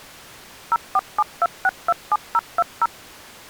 DTMF, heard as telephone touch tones, dialled by machine, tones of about 40 ms. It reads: 0472627020